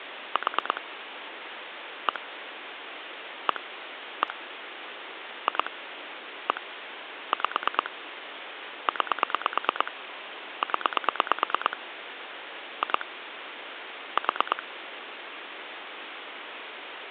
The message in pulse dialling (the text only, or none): 4 1 1 1 2 1 5 9 0 2 4